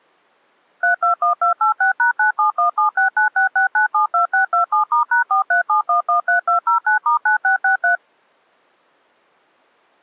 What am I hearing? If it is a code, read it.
DTMF, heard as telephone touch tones, dialled by machine, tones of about 120 ms. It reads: 321286#97176966972627*#437113209*9663